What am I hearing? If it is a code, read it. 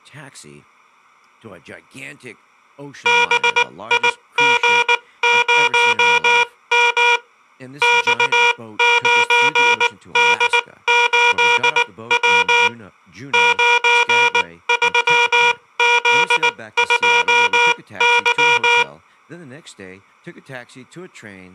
Morse code, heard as a buzzer, machine-sent, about 19 wpm, spaced as for 16 wpm, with speech in English. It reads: BIG0M X9D8W 93Z2Y